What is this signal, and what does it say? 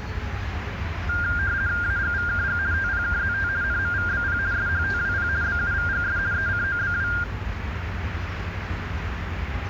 RTTY (50 baud, 170 Hz shift), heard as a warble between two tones, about 1500 Hz centre, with radio static and the noise of a residential street. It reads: AGVKG TPKZT NMVBP SHTWP BUVGS ECOBW